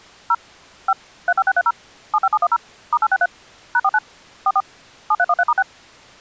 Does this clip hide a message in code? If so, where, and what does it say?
Yes: DTMF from 0.3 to 5.6 s, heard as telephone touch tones, dialled by machine, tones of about 50 ms. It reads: 0 5 35630 75710 *863 #49 44 7313*6